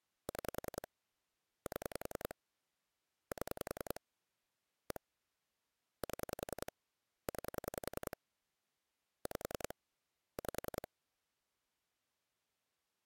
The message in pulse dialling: 6 7 7 1 7 9 5 5

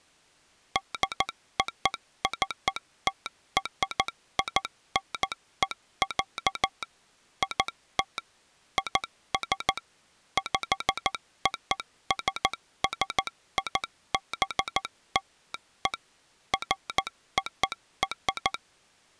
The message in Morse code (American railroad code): DOCTRINE, IT IS POSSIBLE FOR

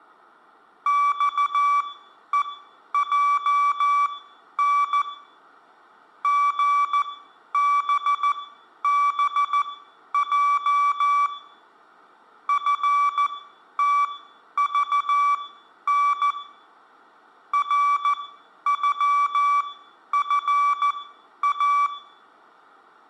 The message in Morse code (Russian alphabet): ЬЕЙН ГББЙ ФТЖН РЮФА

